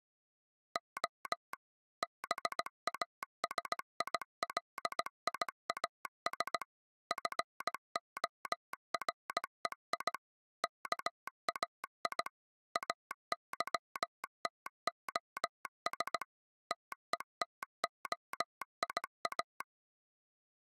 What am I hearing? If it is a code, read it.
Morse code (Greek alphabet), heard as a telegraph sounder, machine-sent, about 17 wpm. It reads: Ο ΒΑΣΙΛΙΑΣ ΦΟΡΕΙ ΚΑΙ ΑΥΤΟΣ ΤΕΤΟΙΑ